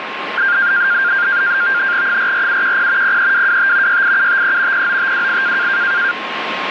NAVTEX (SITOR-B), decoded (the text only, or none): 44710 03225 68753 09528